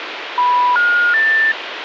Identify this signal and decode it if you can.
Telephone call progress tone (North American plan), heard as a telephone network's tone, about 980, 1430, 1800 Hz, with phone line noise. Special information tone.